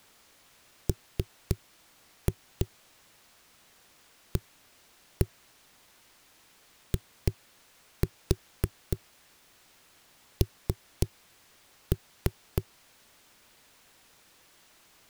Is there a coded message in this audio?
Yes: tap code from 0.9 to 12.7 s, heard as knocks on a wall, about 3 knocks a second. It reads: MAIN